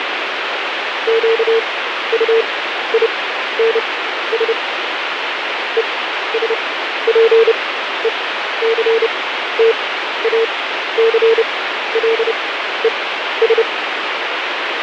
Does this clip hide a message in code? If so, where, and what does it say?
Yes: Morse code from 1.0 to 13.7 s, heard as a keyed tone, machine-sent, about 30 wpm, spaced as for 13 wpm, 450 Hz, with radio static. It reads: QUINS ESPECTACLES